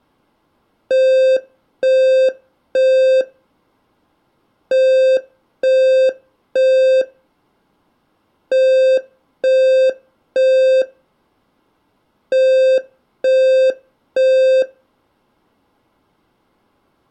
Alarm pattern, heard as an alarm's beeps, played four times, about 520 Hz. Temporal three. Smoke or fire, evacuate.